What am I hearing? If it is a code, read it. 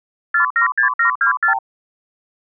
Multi-frequency trunk signalling (R2, with the far end's replies), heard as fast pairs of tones, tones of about 110 ms. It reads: 476724